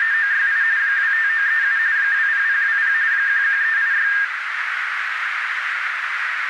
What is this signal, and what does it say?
RTTY (45.45 baud, 170 Hz shift), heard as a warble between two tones, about 1700 Hz centre, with radio static and a narrow filter. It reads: … 25937 20020 11386